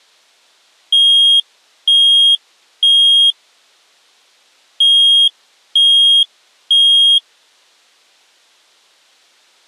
Alarm pattern, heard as an alarm's beeps, played twice, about 3250 Hz. Temporal three. Smoke or fire, evacuate.